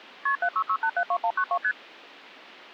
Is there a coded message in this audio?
Yes: multi-frequency trunk signalling (R1, as on North American trunks) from 0.3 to 1.7 s, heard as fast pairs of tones, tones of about 70 ms. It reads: KP 766872192 ST